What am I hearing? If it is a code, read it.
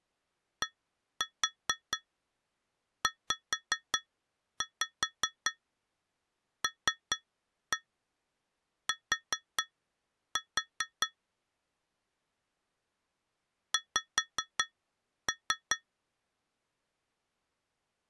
Tap code, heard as taps on glass, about 4 knocks a second. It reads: DZLT X